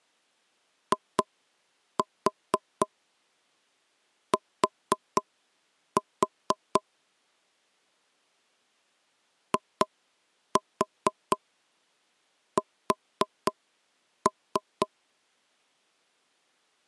Tap code, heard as taps on a table, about 4 knocks a second. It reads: IT IS